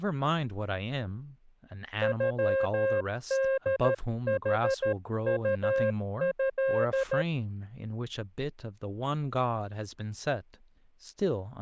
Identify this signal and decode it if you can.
Morse code (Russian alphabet), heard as a keyed tone, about 13 wpm, 540 Hz, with speech in English. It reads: ЮДХУЭ